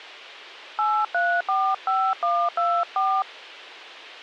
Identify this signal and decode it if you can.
DTMF, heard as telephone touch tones, dialled by hand, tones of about 260 ms. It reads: 8345124